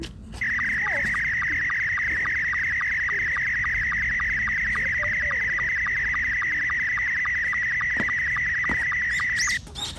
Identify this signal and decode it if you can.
SSTV (slow-scan television), Scottie S2, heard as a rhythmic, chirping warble, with the noise of a park.